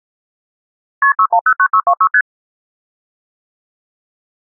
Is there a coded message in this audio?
Yes: multi-frequency trunk signalling (R1, as on North American trunks) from 1.0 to 2.2 s, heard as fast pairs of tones, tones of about 70 ms. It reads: KP 6109626 ST